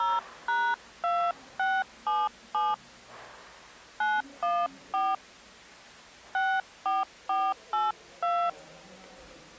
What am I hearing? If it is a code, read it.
DTMF, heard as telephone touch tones, dialled by hand, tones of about 210 ms, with the noise of a subway station. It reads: 0#2677 914 64482